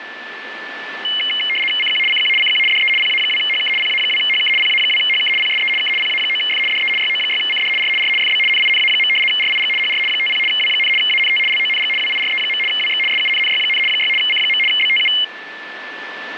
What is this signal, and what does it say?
RTTY (75 baud, 850 Hz shift), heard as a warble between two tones, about 2550 Hz centre, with radio static and a steady whistle near 1750 Hz. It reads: CQ CQ CQ DE PA2HK PA2HK PA2HK PSE K PA9F DE YO6CD R R FB NINA. RIG HR 50 W, ANT LONG WIRE. WX SUNNY, 6 C. BTU